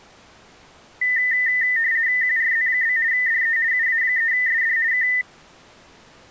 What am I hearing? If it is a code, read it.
RTTY (50 baud, 170 Hz shift), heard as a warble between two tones, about 1900 Hz centre. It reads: QRZ? DE UA3SD K